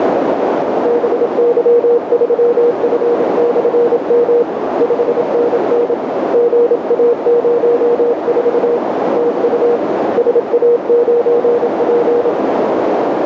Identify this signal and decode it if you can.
Morse code, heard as a keyed tone, hand-sent with a paddle, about 27 wpm, 480 Hz, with heavy radio static and a narrow filter. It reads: BY3F/M 5NN GA04 TU SA9P